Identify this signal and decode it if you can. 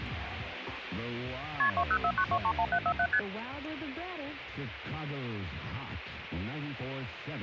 Multi-frequency trunk signalling (R1, as on North American trunks), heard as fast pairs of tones, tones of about 70 ms, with phone line noise. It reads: KP 2049231747 ST